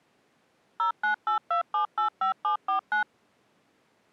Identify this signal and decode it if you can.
DTMF, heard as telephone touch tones, dialled by machine, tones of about 110 ms. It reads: 0982785749